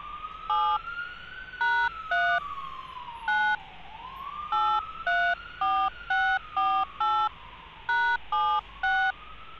DTMF, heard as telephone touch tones, dialled by hand, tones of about 270 ms, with hum and street noise. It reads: 7 #3 9 834648 #76